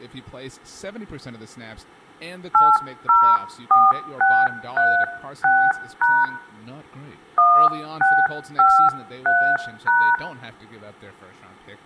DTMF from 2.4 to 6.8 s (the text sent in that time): 804636#